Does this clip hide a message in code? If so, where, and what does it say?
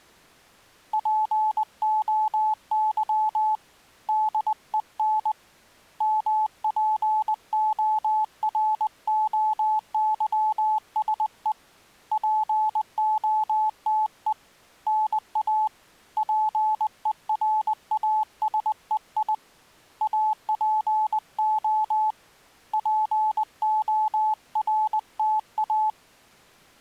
Yes: Morse code (Greek alphabet) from 0.9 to 26.0 s, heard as a keyed tone, hand-sent with a paddle, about 20 wpm, 860 Hz. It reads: ΠΟΥ ΔΕΝ ΜΠΟΡΟΥΣΕ ΠΟΤΕ ΝΑ ΠΕΡΑΣΕΙ ΑΠΟ ΠΟΡΤΑ